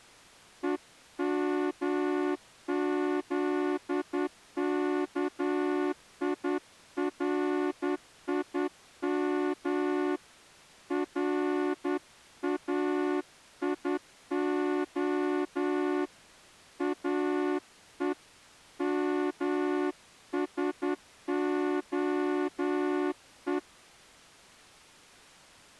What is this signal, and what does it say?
Morse code (Hebrew alphabet), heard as a horn, hand-sent with a straight key, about 10 wpm. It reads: ומזכירים ראיה או משהו